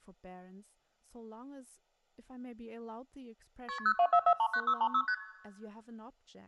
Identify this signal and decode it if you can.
Multi-frequency trunk signalling (R1, as on North American trunks), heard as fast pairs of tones, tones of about 70 ms, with speech in English. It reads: KP 024439636 ST